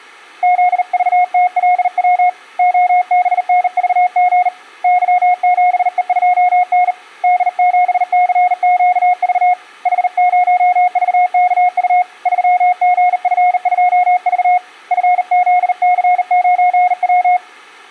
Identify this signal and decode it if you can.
Morse code, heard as a keyed tone, hand-sent with a bug key, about 39 wpm, 720 Hz. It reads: ZVTLW OBNVG Y7E2N D7CQV H0VKU 3GF2V FZC9W